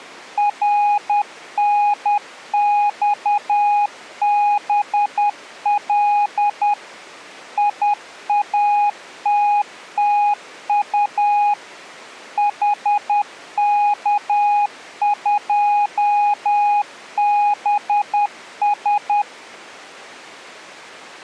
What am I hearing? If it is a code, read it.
Morse code, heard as a keyed tone, machine-sent, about 10 wpm, 830 Hz. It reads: RNXBL IATTU HK2BS